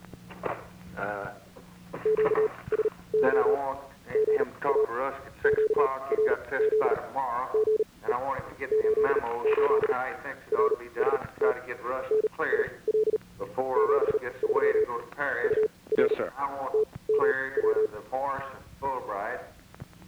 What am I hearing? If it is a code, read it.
Morse code, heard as a keyed tone, machine-sent, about 38 wpm, spaced as for 23 wpm, 430 Hz. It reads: QSY GA QRZ GE 88 RST NIL 73 UR TMW